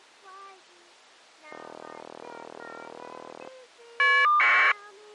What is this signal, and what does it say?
Caller ID data burst, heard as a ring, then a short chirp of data, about 1200 baud.